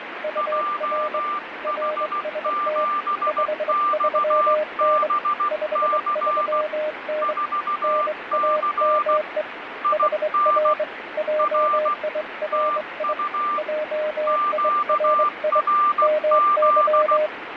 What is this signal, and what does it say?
Morse code, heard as two keyed tones, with radio static and fading. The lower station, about 23 wpm, 610 Hz: UR RST 53N 53N NAME HR JIRI JIRI MY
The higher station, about 16 wpm, 1190 Hz: JH7XBC 4C IN R TU QRZ